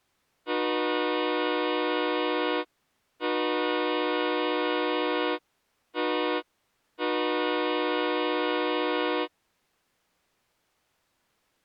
Train horn signal, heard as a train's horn. 2 long, 1 short, 1 long. On North American railways: approaching a public crossing.